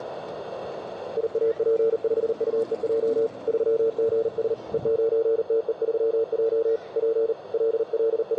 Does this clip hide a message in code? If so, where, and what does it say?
Yes: Morse code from 1.1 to 8.4 s, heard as a keyed tone, hand-sent with a paddle, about 39 wpm, 450 Hz, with radio static, a narrow filter and the noise of a park. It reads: IAP5UEJ 3GS E9TE3J P …